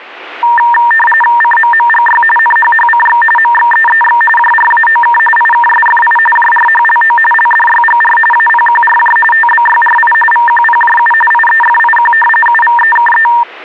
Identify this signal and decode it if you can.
RTTY (45.45 baud, 850 Hz shift), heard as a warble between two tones, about 1370 Hz centre. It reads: CMMGY NHHCX MXEEX JRAOK IKSFI JRHLO LDYGR APQRJ TBYRI VQPJU IEFIQ UVEKE